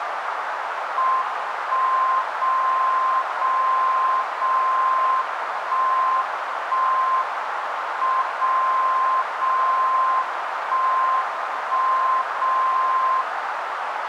Radio time signal (WWVB), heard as a tone whose level steps once a second, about 1040 Hz, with radio static and a narrow filter. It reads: 1 0 0 0 1 1 M 0 0 1 1 0